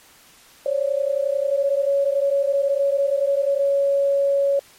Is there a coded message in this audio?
Yes: PSK31 (31.25 baud) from 0.7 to 4.6 s, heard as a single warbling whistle, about 560 Hz.